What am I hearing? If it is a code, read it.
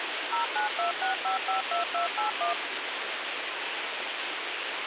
DTMF, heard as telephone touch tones, dialled by machine, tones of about 120 ms, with radio hiss. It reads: 0926552281